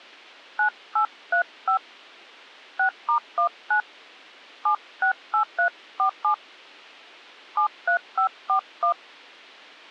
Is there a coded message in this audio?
Yes: DTMF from 0.6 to 8.9 s, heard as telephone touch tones, dialled by hand, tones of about 100 ms, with a squelch burst at the end. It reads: 9835 6*19 768347 73541